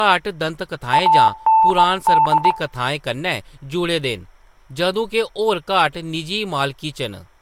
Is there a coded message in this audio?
Yes: Morse code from 0.9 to 2.6 s, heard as a keyed tone, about 19 wpm, 890 Hz, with speech in Dogri. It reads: AND